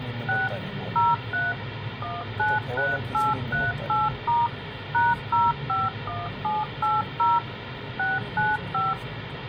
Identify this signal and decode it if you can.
DTMF, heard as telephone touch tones, dialled by machine, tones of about 190 ms, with radio hiss and the noise inside a car. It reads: 6 03 193838* #051780 695